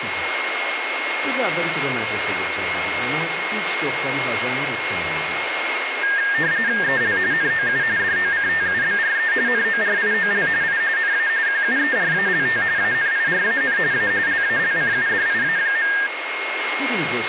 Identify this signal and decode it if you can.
RTTY (45.45 baud, 170 Hz shift), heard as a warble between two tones, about 1700 Hz centre, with radio static, a steady whistle near 2150 Hz and speech in Persian. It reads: EL NOU DOCTUBRE NORIOL I NA QUERALT ANIRAN A LALCUDIA.